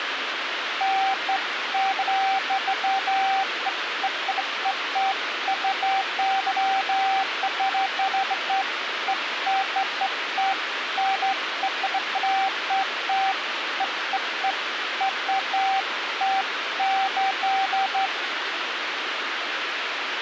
Beeps of irregular length, with radio hiss. There is no code.